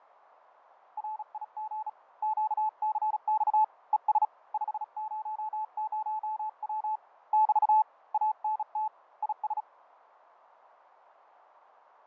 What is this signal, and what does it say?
Morse code, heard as a keyed tone, hand-sent with a bug key, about 36 wpm, 860 Hz, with radio static and fading. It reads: RIG QCX ES 500W <BT> ANT IS